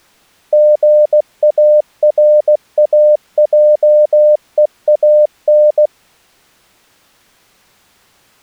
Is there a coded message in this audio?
Yes: Morse code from 0.5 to 5.9 s, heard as a keyed tone, machine-sent, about 16 wpm, 600 Hz. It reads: GARAJEAN